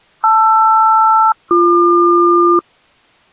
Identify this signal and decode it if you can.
Aircraft SELCAL, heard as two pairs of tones. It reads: LR-BQ